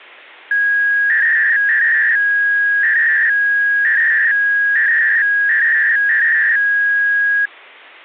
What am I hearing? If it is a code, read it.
300-baud modem data (V.21 tones), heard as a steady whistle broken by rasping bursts, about 300 baud, 200 Hz shift.